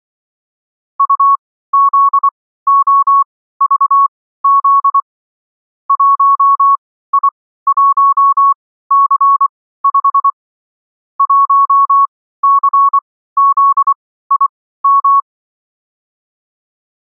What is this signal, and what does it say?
Morse code, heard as a keyed tone, machine-sent, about 24 wpm, spaced as for 15 wpm, 1110 Hz. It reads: UZOVZ 1I1C5 1CZIM